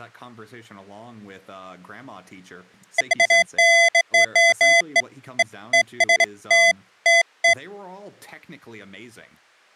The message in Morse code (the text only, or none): none